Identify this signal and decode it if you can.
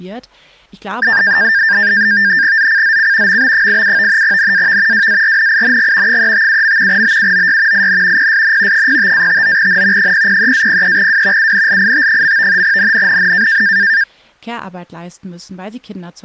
NAVTEX (SITOR-B), 100 baud, 170 Hz shift, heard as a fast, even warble, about 1700 Hz centre, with speech in German. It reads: ZCZC MB87 NAV WARNING 357. BUOY IN PSN 05-59N 003-03W UNLIT. NNNN